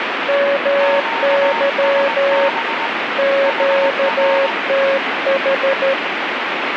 Morse code, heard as two keyed tones, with radio static. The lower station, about 13 wpm, 550 Hz: MY QTH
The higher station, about 20 wpm, 920 Hz: QSB HR